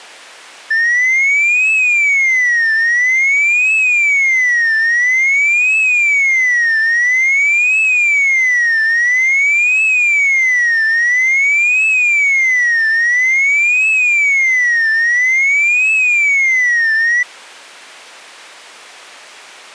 A tone that sweeps in pitch again and again. There is no code.